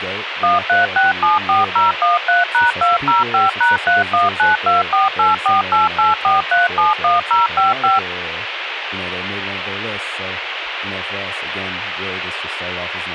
DTMF, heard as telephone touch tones, dialled by machine, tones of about 160 ms, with radio hiss and speech in English. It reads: 13674013#205#3192484884371055